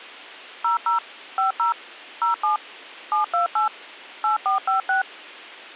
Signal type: DTMF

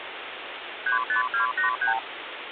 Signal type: multi-frequency trunk signalling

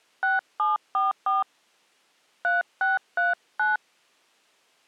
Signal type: DTMF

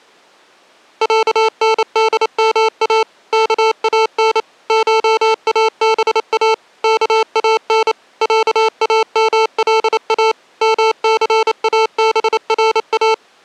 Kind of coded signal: Morse code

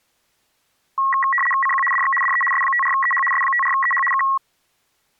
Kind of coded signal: RTTY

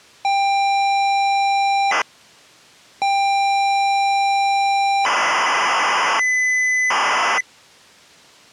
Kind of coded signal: ZX Spectrum tape loading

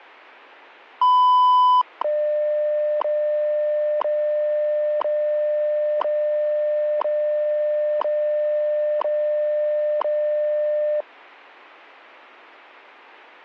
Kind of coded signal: radio time signal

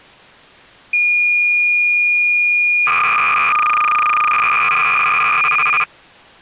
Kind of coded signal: cassette data (Kansas City type)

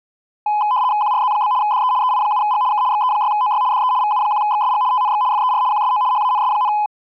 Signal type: RTTY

